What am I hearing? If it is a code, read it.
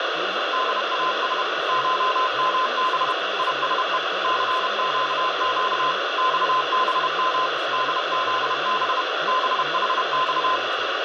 Morse code (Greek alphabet), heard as a keyed tone, machine-sent, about 31 wpm, 1030 Hz, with heavy radio static and speech in Gujarati. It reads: ΔΑΣ ΧΜΒ ΙΣΕ ΘΨΨ ΞΒΜ ΔΖΒ ΒΗΞ